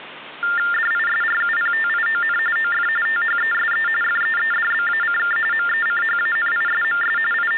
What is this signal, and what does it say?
TTY/TDD text telephone tones (45.45 baud Baudot), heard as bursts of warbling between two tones, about 400 Hz shift, 1600 Hz centre, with phone line noise. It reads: DISRUPTION OF THESE FEEDBACK MECHANISMS …